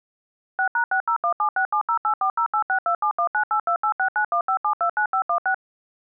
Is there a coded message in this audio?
Yes: DTMF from 0.6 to 5.5 s, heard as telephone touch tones, dialled by machine, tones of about 90 ms. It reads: 6#60176708408627198286915729516